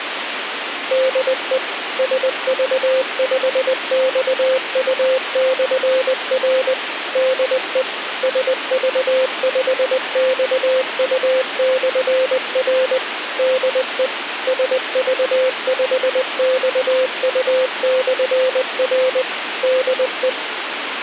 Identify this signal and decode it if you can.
Morse code, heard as a keyed tone, machine-sent, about 20 wpm, 520 Hz, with radio hiss. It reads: DE SV5XU/R DE SV5XU/R DE SV5XU/R DE